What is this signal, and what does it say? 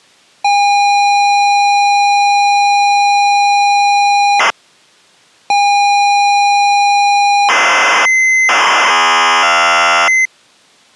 ZX Spectrum tape loading, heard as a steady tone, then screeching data.